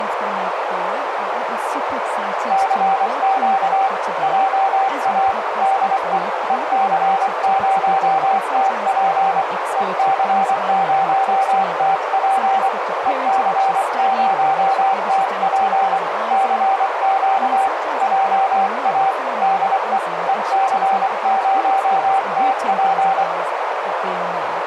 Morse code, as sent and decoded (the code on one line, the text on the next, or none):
-.-. --.- / .--- .- / -.. . / . -.-. ----- - .--. / . -.-. ----- - .--. / . -.-. ----- - .--. / -.-. --.- / .--- .- / -.. . / . -.-. ----- - .--.
CQ JA DE EC0TP EC0TP EC0TP CQ JA DE EC0TP